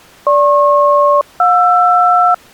Aircraft SELCAL, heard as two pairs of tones. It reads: GP-JR